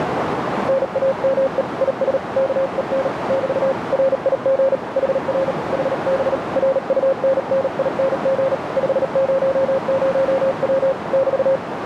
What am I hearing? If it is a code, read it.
Morse code, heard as a keyed tone, hand-sent with a paddle, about 38 wpm, 540 Hz, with radio static and a narrow filter. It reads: NAME IS KEN <BT> RIG HR HB RUNNING 500W <BT>